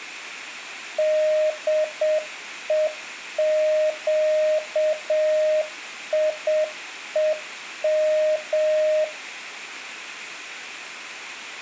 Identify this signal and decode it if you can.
Morse code (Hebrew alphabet), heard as a keyed tone, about 7 wpm, 620 Hz, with room echo. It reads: דוקיום